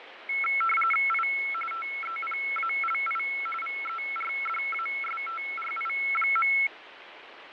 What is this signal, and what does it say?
RTTY (45.45 baud, 850 Hz shift), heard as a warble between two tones, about 1750 Hz centre, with radio static and fading. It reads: I TEPALI VERDASTRI.